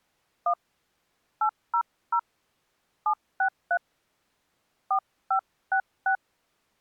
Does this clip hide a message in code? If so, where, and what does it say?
Yes: DTMF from 0.5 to 6.2 s, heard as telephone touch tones, dialled by hand, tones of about 80 ms. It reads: 1 800 763 4566